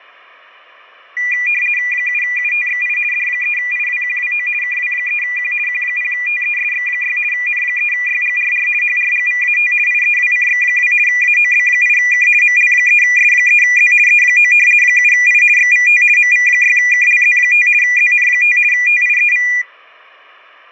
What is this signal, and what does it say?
RTTY (50 baud, 450 Hz shift), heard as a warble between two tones, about 2200 Hz centre, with fading. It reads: 7UTXI D3IWQWO KW3Q Q0TESX6 N3YGRR HRGVAT IEWCX2 AOB8K ML3S3Z E9 7I XVT MV6KLZ5 ZN5 TIEV